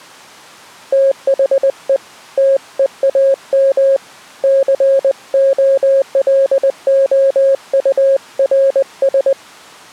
Morse code, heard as a keyed tone, hand-sent with a paddle, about 20 wpm, 540 Hz. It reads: THE TEAM COLOURS